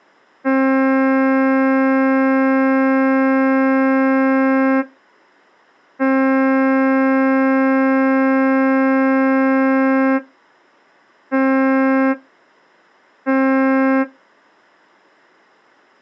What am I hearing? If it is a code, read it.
Ship horn signal, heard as a ship's horn, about 270 Hz. 2 long, 2 short. At sea: I intend to overtake on your port side.